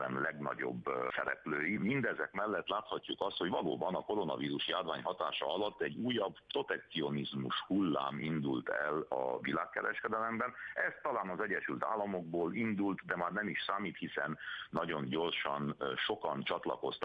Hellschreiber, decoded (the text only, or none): none